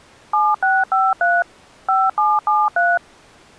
DTMF, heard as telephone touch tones, dialled by machine, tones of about 210 ms. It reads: 7653 5773